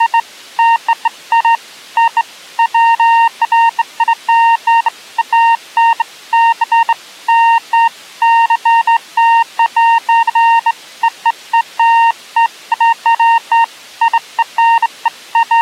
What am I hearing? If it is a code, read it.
Beeps of irregular length. There is no code.